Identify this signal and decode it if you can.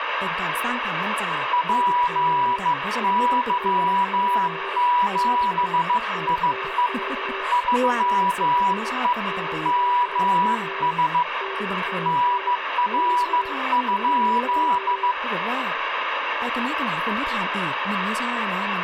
Morse code, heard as two keyed tones, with radio static and speech in Thai. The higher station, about 15 wpm, 980 Hz: PY7IE 3E MS NR?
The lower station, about 25 wpm, 390 Hz: SO HW? <BT> TNX FER QSO DAN <BT> VY